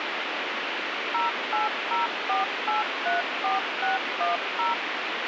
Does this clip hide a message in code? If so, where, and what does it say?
Yes: DTMF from 1.1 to 4.7 s, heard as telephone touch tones, dialled by machine, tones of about 150 ms, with radio hiss and a squelch burst at the end. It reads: 0804834610